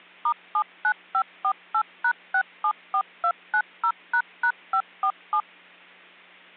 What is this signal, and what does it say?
DTMF, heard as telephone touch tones, dialled by machine, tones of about 70 ms. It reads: *79548#674290##547